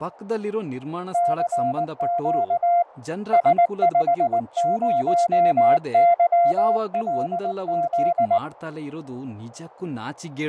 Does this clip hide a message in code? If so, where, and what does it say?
Yes: Morse code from 1.1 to 8.4 s, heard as a keyed tone, hand-sent with a paddle, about 19 wpm, 690 Hz, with fading and speech in Kannada. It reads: CQ S50YLZ